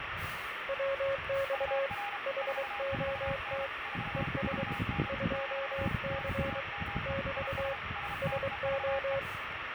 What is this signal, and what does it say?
Morse code, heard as two keyed tones, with radio static and the noise of a residential street. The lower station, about 23 wpm, 550 Hz: WX HOT ES 2C <BT> SO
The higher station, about 33 wpm, 810 Hz: UR 44N 44N - NAME IS STEVE